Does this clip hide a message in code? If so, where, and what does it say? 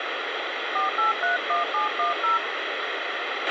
Yes: DTMF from 0.8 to 2.4 s, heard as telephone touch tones, dialled by hand, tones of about 140 ms, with radio hiss and a squelch burst at the end. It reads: 4831710